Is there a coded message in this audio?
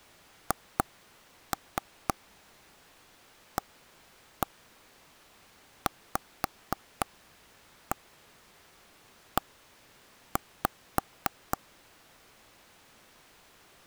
Yes: tap code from 0.5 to 11.6 s, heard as taps on a table, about 4 knocks a second. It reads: HAVE